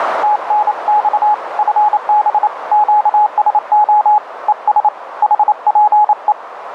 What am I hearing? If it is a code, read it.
Morse code, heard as a keyed tone, hand-sent with a paddle, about 28 wpm, 840 Hz, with radio static and a narrow filter. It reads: TNX FB QSO ES HPE